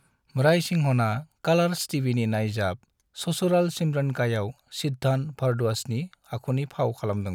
Speech in Bodo. There is no code.